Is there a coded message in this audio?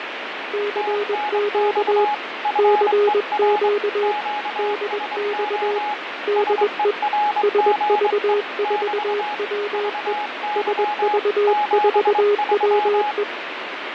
Yes: Morse code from 0.5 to 13.3 s, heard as two keyed tones, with radio static and fading. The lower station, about 21 wpm, 410 Hz: CQ CQ DX DE SV4WE SV4WE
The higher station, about 23 wpm, 840 Hz: TNX FER QSO SERGE <BT> VY 73